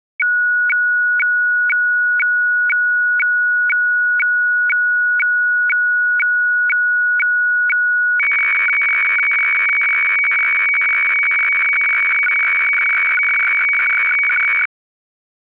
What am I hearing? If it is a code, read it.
Weather fax (radiofax), 120 lines a minute, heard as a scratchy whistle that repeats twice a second.